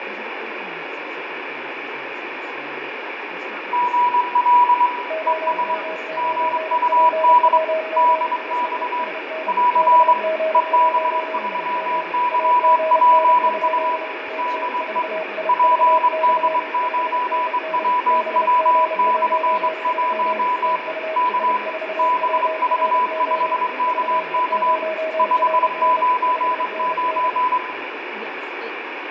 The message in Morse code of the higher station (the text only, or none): GL ES GUD DX <AR> EB3YPU DE PD9WW/1 K BV5KK 599